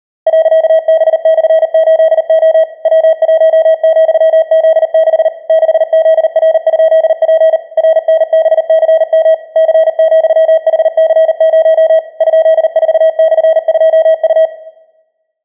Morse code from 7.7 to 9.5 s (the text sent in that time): RNBCM